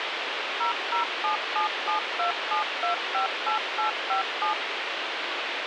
DTMF, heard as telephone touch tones, dialled by machine, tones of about 120 ms, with radio hiss. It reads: 0077727258857